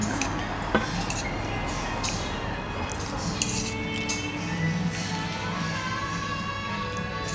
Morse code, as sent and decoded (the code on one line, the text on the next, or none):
none